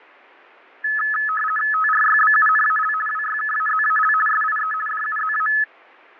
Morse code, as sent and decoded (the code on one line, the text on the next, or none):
none